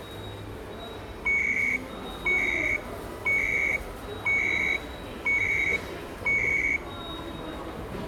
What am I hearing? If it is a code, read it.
Radio time signal (CHU, Canada), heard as beeps and data bursts, one a second, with the noise of a subway station.